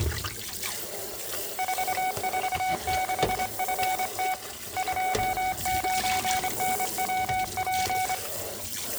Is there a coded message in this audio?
Yes: Morse code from 1.5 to 8.2 s, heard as a keyed tone, hand-sent with a straight key, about 25 wpm, 750 Hz, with room echo and kitchen noise. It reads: 446FT 29NWP